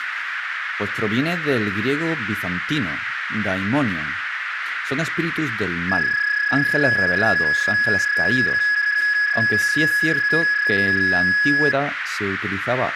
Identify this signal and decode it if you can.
PSK31 (31.25 baud), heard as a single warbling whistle, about 1700 Hz, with radio static, a narrow filter and speech in Spanish.